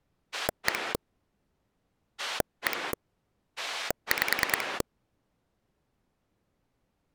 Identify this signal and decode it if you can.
Pulse dialling, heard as a rotary dial, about 9 pulses a second. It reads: 1 1 5